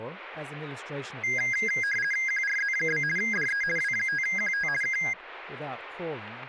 RTTY (50 baud, 450 Hz shift), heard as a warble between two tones, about 1850 Hz centre, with speech in English. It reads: QRZ? DE W5QT K